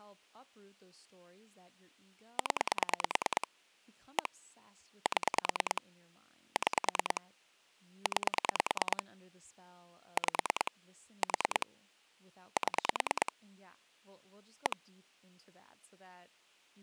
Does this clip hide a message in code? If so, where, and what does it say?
Yes: pulse dialling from 2.4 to 14.7 s, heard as clicks on a phone line, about 9 pulses a second, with speech in English. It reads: 0 1 7 6 9 5 4 7 1